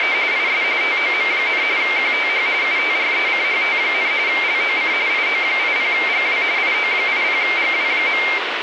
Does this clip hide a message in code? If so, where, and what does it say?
Yes: RTTY (45.45 baud, 170 Hz shift) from 0.0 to 8.4 s, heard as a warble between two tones, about 2200 Hz centre, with radio static. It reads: … IS TOM, QTH UTRECHT, LOC IO80GW IO80GW.